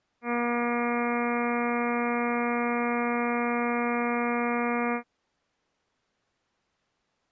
Ship horn signal, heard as a ship's horn, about 240 Hz. 1 long. At sea: a vessel nearing a blind bend, or under power and making way in fog.